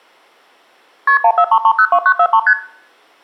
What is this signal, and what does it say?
Multi-frequency trunk signalling (R1, as on North American trunks), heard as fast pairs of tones, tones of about 70 ms, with room echo. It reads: KP 143302943 ST